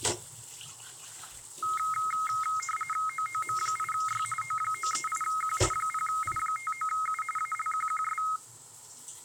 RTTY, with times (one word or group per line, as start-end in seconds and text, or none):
3.1-4.2 OOM8Y
4.4-5.6 O938Q
5.7-7.2 0I59U
7.4-8.2 ALQQS